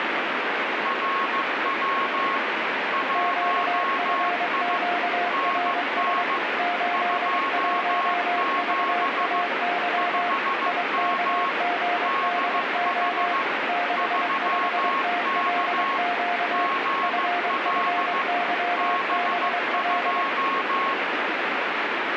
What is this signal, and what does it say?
Morse code, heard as two keyed tones, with heavy radio static. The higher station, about 15 wpm, 1090 Hz: RW 1I NN 27 5M DH 3K GL B2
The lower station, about 23 wpm, 710 Hz: QFQRS 81VAY IKGDO 65TLQ FFYBL